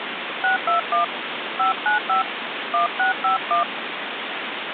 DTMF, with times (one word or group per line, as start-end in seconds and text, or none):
0.4-1.0 621
1.6-2.2 595
2.7-3.6 1651